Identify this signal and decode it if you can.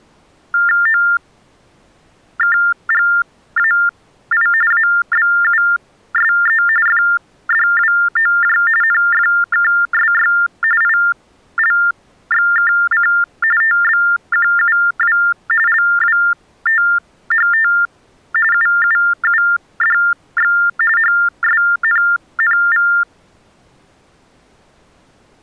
TTY/TDD text telephone tones (45.45 baud Baudot), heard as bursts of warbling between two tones, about 400 Hz shift, 1600 Hz centre. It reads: OKGAI ABUSE FDWOJ NFKSY ILXKC TBQUW LWTHT UUUDX HSNNV